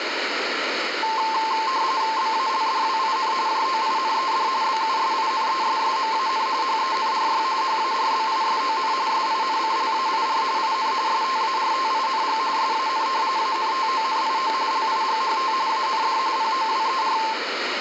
RTTY (45.45 baud, 170 Hz shift), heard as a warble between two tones, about 970 Hz centre, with radio static and room echo. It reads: BALDWIN JOINED BUSINESSMAN HENRY HARBISON SINCLAIR IN STARTING SAN ANTONIO LIGHT AND POWER